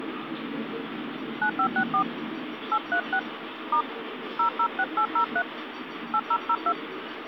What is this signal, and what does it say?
DTMF, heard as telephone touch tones, dialled by hand, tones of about 80 ms, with phone line noise and the noise of a park. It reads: 9564 836 * 006803 8002